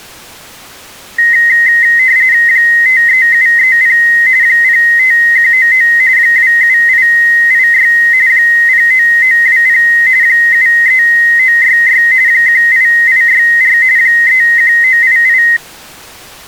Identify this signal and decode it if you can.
RTTY (45.45 baud, 170 Hz shift), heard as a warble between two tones, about 1950 Hz centre. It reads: 53730 05199 27886 09920 73966 18864 31988